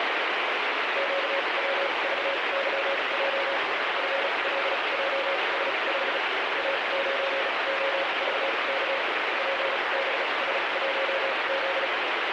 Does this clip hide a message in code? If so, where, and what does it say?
Yes: Morse code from 0.9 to 11.9 s, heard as a keyed tone, machine-sent, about 36 wpm, spaced as for 28 wpm, 550 Hz, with heavy radio static. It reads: QWVYJ FLJS5 A9OVK PBS1Z